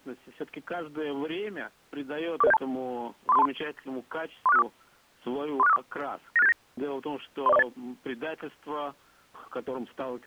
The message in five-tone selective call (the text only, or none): 44072 34323 34654 34654 96879 30408